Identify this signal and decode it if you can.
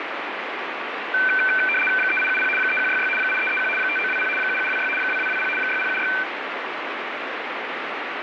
RTTY (75 baud, 850 Hz shift), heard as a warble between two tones, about 1950 Hz centre, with radio static. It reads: 3870 3166 8331 5920 7726 2220 6076